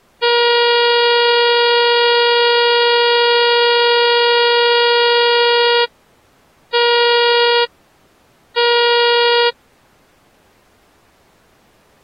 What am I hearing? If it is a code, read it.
Ship horn signal, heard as a ship's horn, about 480 Hz. 1 long, 2 short. At sea: a vessel in fog that is sailing, fishing, towing or hampered.